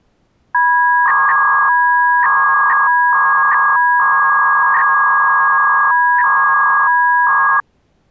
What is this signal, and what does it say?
300-baud modem data (V.21 tones), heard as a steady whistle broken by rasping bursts, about 300 baud, 200 Hz shift.